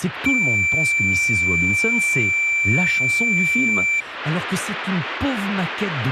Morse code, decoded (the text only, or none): none